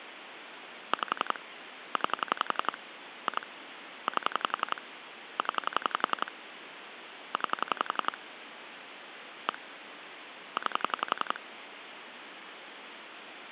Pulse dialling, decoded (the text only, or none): 5 9 2 8 0 9 1 9